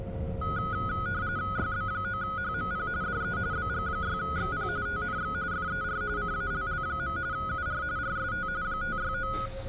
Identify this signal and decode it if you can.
RTTY (45.45 baud, 170 Hz shift), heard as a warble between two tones, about 1360 Hz centre, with a steady whistle near 540 Hz and the noise inside a bus. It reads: YB9HMP DE BG6XP TNX FER CALL. UR RST 569